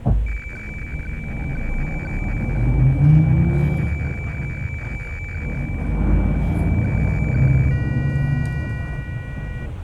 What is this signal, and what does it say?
Weather fax (radiofax), 120 lines a minute, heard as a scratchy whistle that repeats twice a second, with radio static and the noise inside a bus.